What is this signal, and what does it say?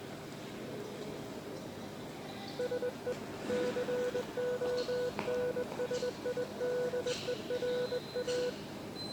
Morse code, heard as a keyed tone, hand-sent with a straight key, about 21 wpm, 490 Hz, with the noise of a subway station. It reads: SE CONSIDERA